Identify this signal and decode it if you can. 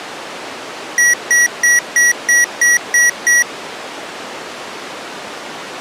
Beep code, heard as beeps from a small speaker, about 1950 Hz. 8 short. In AMI BIOS tables: display memory failure; in Dell tables: LCD failure.